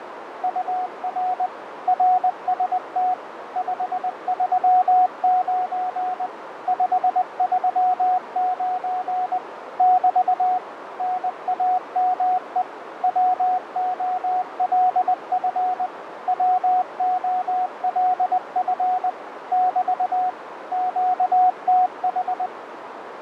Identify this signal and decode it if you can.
Morse code, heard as a keyed tone, machine-sent, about 20 wpm, 740 Hz, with radio static, fading and a narrow filter. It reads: UR RST 539 539 <BT> NAME WOLF WOLF <BT> QTH